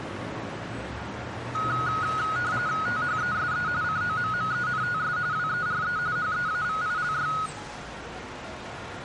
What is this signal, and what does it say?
RTTY (45.45 baud, 170 Hz shift), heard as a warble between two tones, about 1360 Hz centre. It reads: THESE COMMENTS WERE HEAVILY